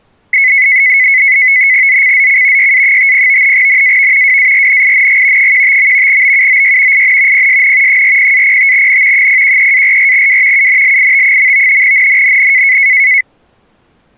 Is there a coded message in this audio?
Yes: NAVTEX (SITOR-B), 100 baud, 170 Hz shift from 0.3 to 13.2 s, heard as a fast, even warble, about 2100 Hz centre. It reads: ZCZC YA50 NAV WARNING 15. BUOY IN PSN 40-05N 013-44W UNLIT. NNNN